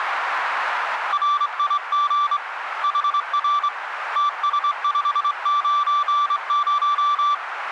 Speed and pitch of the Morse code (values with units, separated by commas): 24 wpm, 1170 Hz